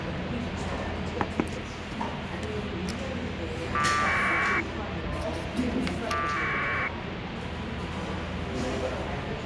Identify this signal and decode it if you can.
Packet radio (AX.25, as in APRS), 1200 baud, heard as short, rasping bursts, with radio hiss and the noise of a cafe.